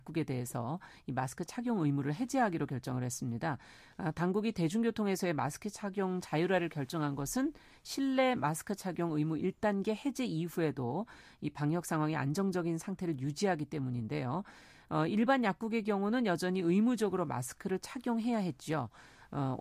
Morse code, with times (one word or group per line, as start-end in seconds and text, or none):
none